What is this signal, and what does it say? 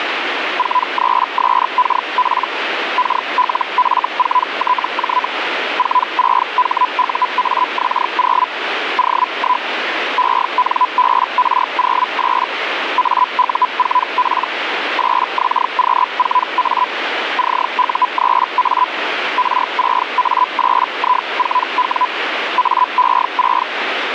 Hellschreiber (Feld-Hell, 122.5 baud), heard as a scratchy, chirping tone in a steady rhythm, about 1000 Hz, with radio static. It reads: 43SKP KLF4TJ 46HUAX0 O1 ENBR08 AU4P 8XQ4A CU3A R6A8I4W AE6